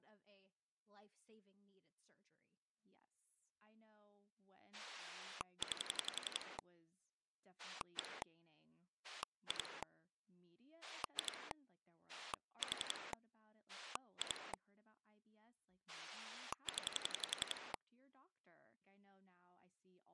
Pulse dialling, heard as a rotary dial, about 11 pulses a second, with speech in English. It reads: 9 1 2 2 4 2 0